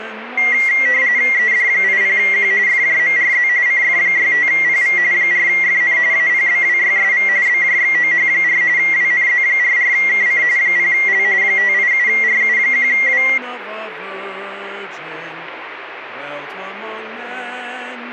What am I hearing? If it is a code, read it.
RTTY (45.45 baud, 170 Hz shift), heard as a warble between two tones, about 2050 Hz centre, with radio static. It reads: ED80Q FJMRZ CF65PV 4FN APBWYSV BJXOH4 WNZ44KC 0L 587RU1W